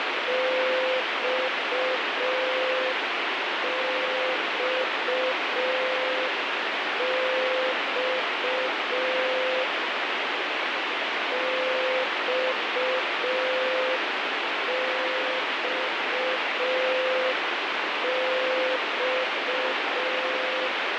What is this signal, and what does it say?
Morse code, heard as a keyed tone, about 5 wpm, 520 Hz, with heavy radio static. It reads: XXX XXX